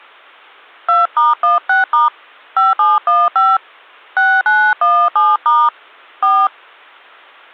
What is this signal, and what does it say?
DTMF, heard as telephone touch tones, dialled by hand, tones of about 190 ms. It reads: 2*16* 5715 6917* 4